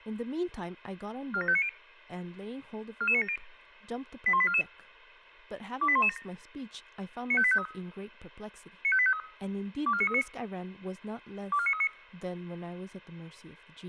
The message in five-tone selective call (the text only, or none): 47590 44970 81844 28117 95853 95853 24939 24939